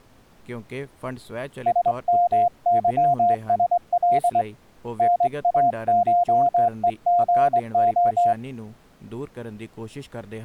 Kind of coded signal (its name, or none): Morse code